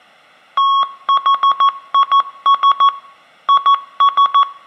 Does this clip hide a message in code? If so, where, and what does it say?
Yes: Morse code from 0.5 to 4.5 s, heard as a keyed tone, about 14 wpm, 1110 Hz, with room echo. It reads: THIS IS